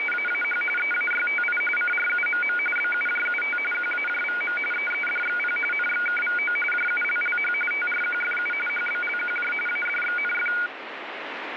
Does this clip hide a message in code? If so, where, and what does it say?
Yes: RTTY (45.45 baud, 850 Hz shift) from 0.0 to 10.7 s, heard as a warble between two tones, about 1850 Hz centre, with radio static. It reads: … EAYTI CRUMM BUJUT QAJVM EEDXP NXKVO JULLH TRQFU HBLQJ ADXNF